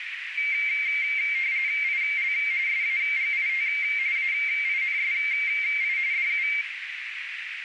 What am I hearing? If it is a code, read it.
RTTY (45.45 baud, 170 Hz shift), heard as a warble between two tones, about 2200 Hz centre, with radio static and a narrow filter. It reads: IL SAGIT AINSI DU